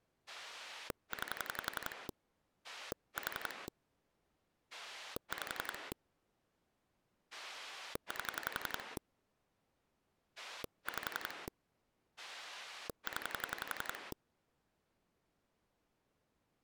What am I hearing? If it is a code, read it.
Pulse dialling, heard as a rotary dial, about 11 pulses a second. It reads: 9 4 5 8 5 0